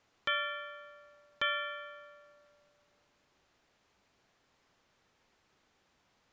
Clock strike, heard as a bell. 2. Two o'clock.